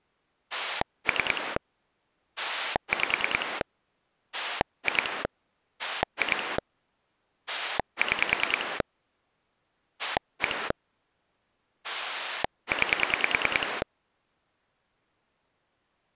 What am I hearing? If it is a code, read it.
Pulse dialling, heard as a rotary dial, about 10 pulses a second. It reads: 3 5 2 2 6 1 9